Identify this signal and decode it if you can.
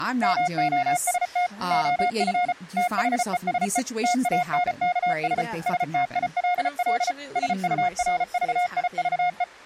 Morse code, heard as a keyed tone, machine-sent, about 34 wpm, 720 Hz, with speech in English. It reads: MOST OF THESE TANKS STILL SURVIVE